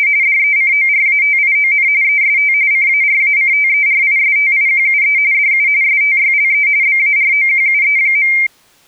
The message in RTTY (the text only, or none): … DECORATION EST CARACTERISTIQUE DU STYLE BAROQUE.